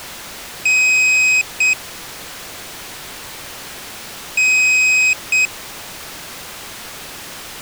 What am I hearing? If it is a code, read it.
Beep code, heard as a piezo beeper, played twice, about 2500 Hz. 1 long, 1 short. In IBM BIOS tables: system board problem.